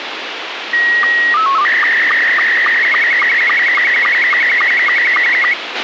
SSTV (slow-scan television), Scottie S2, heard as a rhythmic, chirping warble, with radio hiss and a squelch burst at the end.